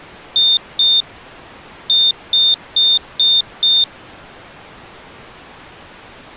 Beep code, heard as a piezo beeper, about 3600 Hz. 2-5.